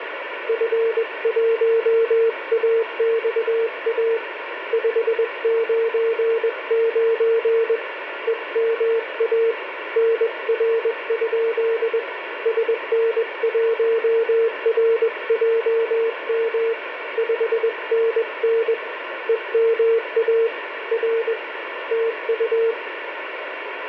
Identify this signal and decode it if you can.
Morse code, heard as a keyed tone, hand-sent with a paddle, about 21 wpm, 460 Hz, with radio static and room echo. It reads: F1AXA 599 EMA NR? SN1RJM 5NN EMA R TU